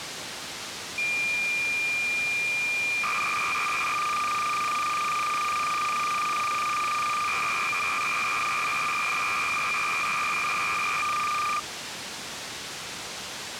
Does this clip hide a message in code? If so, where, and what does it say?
Yes: cassette data (Kansas City type), 300 baud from 1.0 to 11.6 s, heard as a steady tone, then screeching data, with tape hiss.